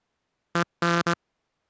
Morse code, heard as a buzzer, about 19 wpm. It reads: EN